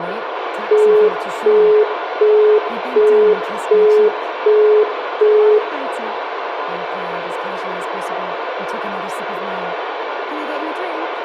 Telephone call progress tone (as in the UK, Australia and similar networks), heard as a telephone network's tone, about 420 Hz, 0.375 s on and 0.375 s off, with phone line noise and room echo. Busy tone.